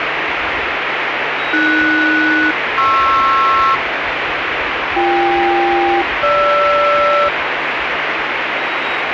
Aircraft SELCAL, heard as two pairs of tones, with radio static and the noise of a subway station. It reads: AS-PR BK-GR